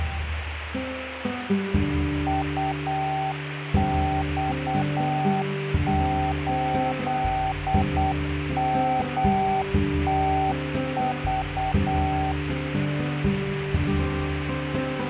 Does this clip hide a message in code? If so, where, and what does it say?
Yes: Morse code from 2.2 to 12.4 s, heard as a keyed tone, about 8 wpm, 770 Hz, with radio static. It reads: UX8MTV